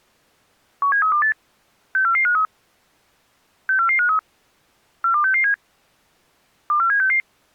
Five-tone selective call (CCIR), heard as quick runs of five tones, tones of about 100 ms. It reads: 17328 64453 64453 42667 24766